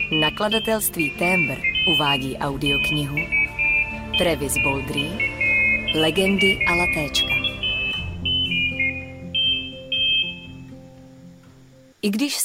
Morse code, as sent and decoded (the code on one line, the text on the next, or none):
none